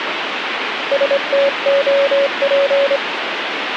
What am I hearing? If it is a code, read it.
Morse code, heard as a keyed tone, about 25 wpm, 560 Hz, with radio static. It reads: STOP